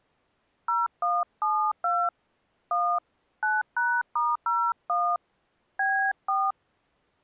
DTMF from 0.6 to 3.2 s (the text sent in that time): 0172 1